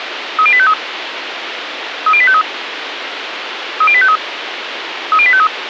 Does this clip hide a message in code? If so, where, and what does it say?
Yes: five-tone selective call (ZVEI) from 0.4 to 5.5 s, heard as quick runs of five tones, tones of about 70 ms, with radio hiss. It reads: 30853 30853 30853 30853